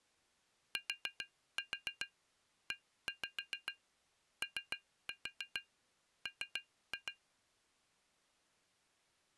Tap code, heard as taps on glass, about 7 knocks a second. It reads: TEOM